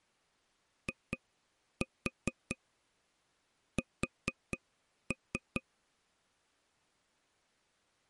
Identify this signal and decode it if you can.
Tap code, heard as taps on a table, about 4 knocks a second. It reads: IS